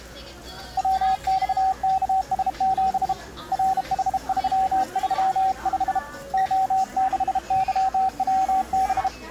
Morse code, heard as a keyed tone, hand-sent with a bug key, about 32 wpm, 760 Hz, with the noise of a crowd indoors. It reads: WXKS7 RH335 O6YWB